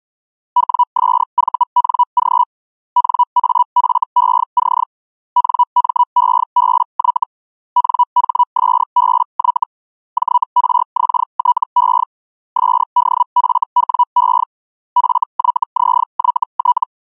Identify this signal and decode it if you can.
Hellschreiber (Feld-Hell, 122.5 baud), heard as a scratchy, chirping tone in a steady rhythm, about 980 Hz. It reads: WSVNG NAFEC NMEBY NHSBY JRXTE SDFWE FYZYT